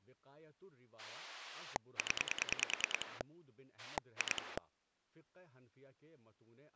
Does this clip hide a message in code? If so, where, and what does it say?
Yes: pulse dialling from 1.0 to 4.6 s, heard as a rotary dial, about 10 pulses a second, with speech in Urdu. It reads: 0 2